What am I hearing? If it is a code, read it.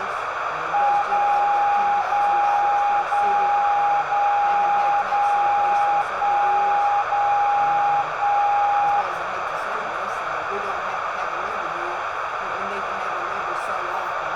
Radio time signal (DCF77), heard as a tone whose level steps once a second, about 820 Hz, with radio static, a narrow filter and room echo. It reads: 0 0 0 0 0 1 0 1